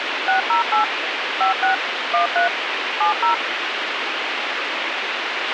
DTMF, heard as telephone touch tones, dialled by machine, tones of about 120 ms, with radio hiss and a squelch burst at the end. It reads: 608 56 13 70